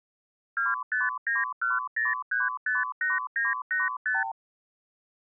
Multi-frequency trunk signalling (R2, with the far end's replies), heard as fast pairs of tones, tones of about 170 ms. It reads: 25910358985